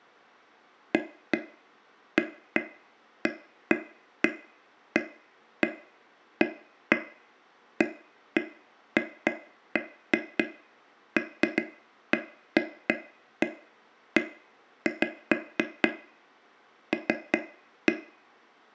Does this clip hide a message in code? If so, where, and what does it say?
No, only irregular taps on a table, with room echo.